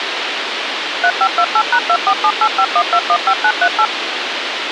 DTMF, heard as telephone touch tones, dialled by machine, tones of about 70 ms, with radio hiss. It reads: 3528#247851215938